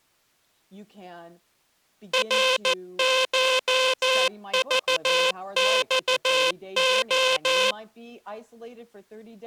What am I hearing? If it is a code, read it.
Morse code (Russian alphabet), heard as a buzzer, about 14 wpm, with speech in English. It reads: РШЖЬО